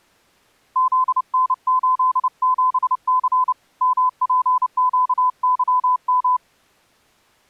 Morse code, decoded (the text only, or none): ZN87C MPQYM